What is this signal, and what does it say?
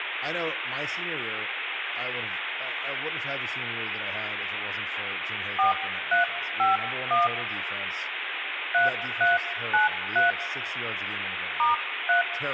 DTMF, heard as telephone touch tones, dialled by hand, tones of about 140 ms, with phone line noise, room echo and speech in English. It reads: 4351 3393 *3